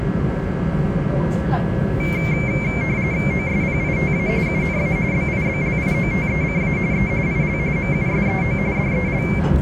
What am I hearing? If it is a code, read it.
RTTY (45.45 baud, 170 Hz shift), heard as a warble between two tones, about 2200 Hz centre, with radio static and the noise inside a subway train. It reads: OSPITA UNA BIBLIOTECA E IL MUSEO DEL